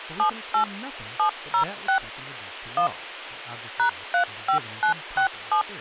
DTMF, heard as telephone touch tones, dialled by machine, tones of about 100 ms, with speech in English. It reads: 78 706 1 #35967